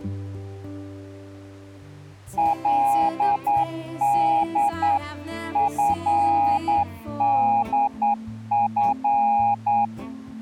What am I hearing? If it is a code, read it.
Morse code (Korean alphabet), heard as a keyed tone, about 9 wpm, 820 Hz. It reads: 그는